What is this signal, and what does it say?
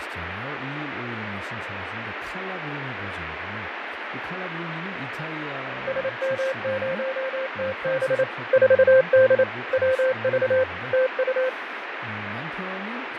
Morse code, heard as a keyed tone, machine-sent, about 28 wpm, 520 Hz, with radio static, fading and speech in Korean. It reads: SM0TB 4D WV TU